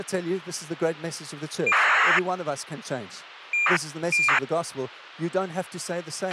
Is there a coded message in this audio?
Yes: ACARS aircraft data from 1.7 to 4.4 s, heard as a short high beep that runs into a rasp, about 2400 baud, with a squelch burst at the end and speech in English.